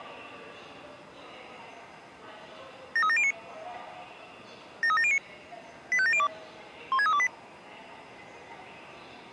Five-tone selective call (ZVEI), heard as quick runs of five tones, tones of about 70 ms, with the noise of a subway station. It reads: 73709 73709 85702 16328